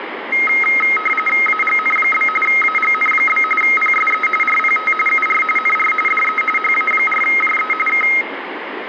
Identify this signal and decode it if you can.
RTTY (45.45 baud, 850 Hz shift), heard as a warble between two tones, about 1700 Hz centre, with radio static and room echo. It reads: AGN? AGN? PSE RPT UR NR DE HA4JE K